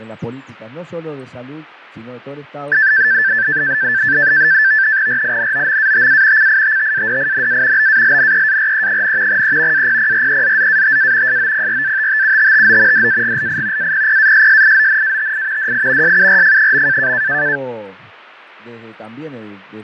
NAVTEX (SITOR-B), 100 baud, 170 Hz shift, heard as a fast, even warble, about 1650 Hz centre, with fading. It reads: RINOMATA CITTADINA BALNEARE, E APPREZZATA SOPRATTUTTO DAGLI APPASSIONATI DI SURF.